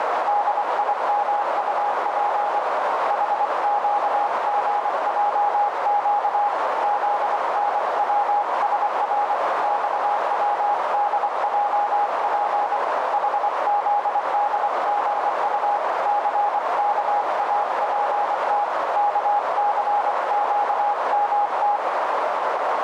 Morse code, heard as a keyed tone, hand-sent with a paddle, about 24 wpm, 820 Hz, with heavy radio static and a narrow filter. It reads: DIMUP HQGJQ ZNWSR XWDJP HZDGU CKAPT KCQMT